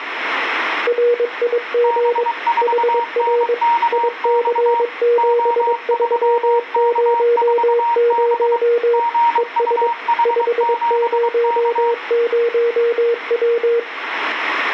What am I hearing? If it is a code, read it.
Morse code, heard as two keyed tones, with radio static. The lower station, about 22 wpm, 470 Hz: RIG HR IC7300 ES 500W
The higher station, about 23 wpm, 940 Hz: B4NKX O3K4B GUH7K